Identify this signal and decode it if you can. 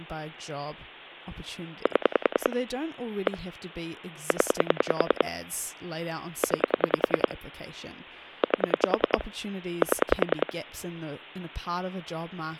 Pulse dialling, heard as clicks on a phone line, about 10 pulses a second, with speech in English. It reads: 7 1 0 9 8 7